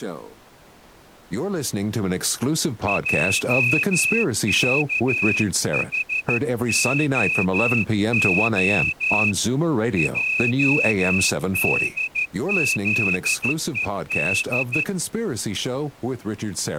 Morse code, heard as a whistle, hand-sent with a straight key, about 13 wpm, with speech in English. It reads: JKHOO JDZED